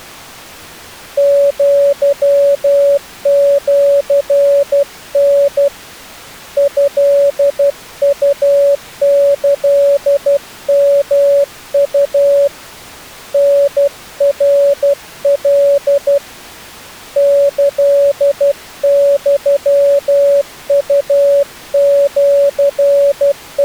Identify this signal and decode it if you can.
Morse code (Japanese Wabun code), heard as a keyed tone, hand-sent with a paddle, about 12 wpm, 560 Hz. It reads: アシタ トウキヨウ タナカ …